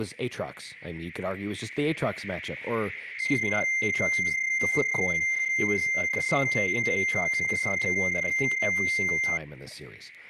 PSK31 (31.25 baud), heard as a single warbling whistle, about 2100 Hz, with speech in English.